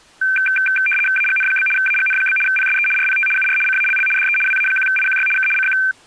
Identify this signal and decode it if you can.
RTTY (75 baud, 850 Hz shift), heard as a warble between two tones, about 1950 Hz centre. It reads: AGN? AGN? PSE RPT UR CALL DE WA1IQY K CQ